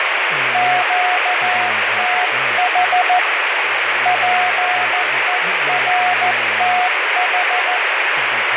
Morse code, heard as a keyed tone, hand-sent with a paddle, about 14 wpm, 730 Hz, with heavy radio static, fading and speech in English. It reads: QTH PERTH